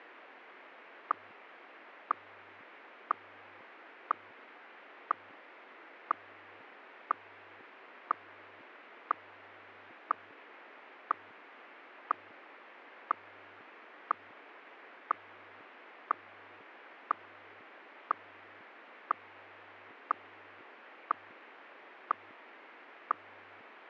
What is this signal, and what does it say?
Radio time signal (WWVH, Hawaii), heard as ticks, one a second, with radio static.